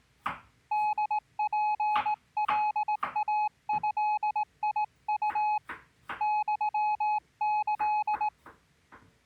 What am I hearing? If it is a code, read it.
Morse code (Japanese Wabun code), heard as a keyed tone, hand-sent with a straight key, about 18 wpm, 850 Hz, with kitchen noise. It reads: ホツカイドウ ユキ